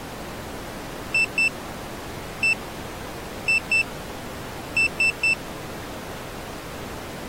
Beep code, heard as a piezo beeper, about 2650 Hz. 2-1-2-3. In Phoenix BIOS tables: ROM copyright notice check failure.